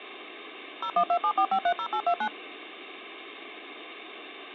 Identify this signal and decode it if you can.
DTMF, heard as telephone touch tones, dialled by machine, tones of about 70 ms. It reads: 01274530829